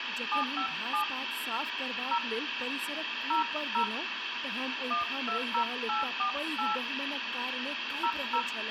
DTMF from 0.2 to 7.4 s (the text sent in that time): 757 0 00 120848